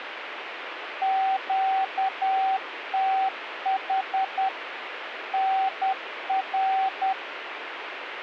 Morse code, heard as a keyed tone, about 10 wpm, 770 Hz, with radio static. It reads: QTH NR